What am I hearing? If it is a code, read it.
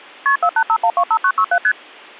Multi-frequency trunk signalling (R1, as on North American trunks), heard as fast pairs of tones, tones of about 70 ms. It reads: KP 485125967 ST